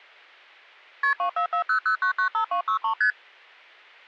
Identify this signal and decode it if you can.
Multi-frequency trunk signalling (R1, as on North American trunks), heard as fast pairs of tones, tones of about 100 ms. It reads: KP 24400995263 ST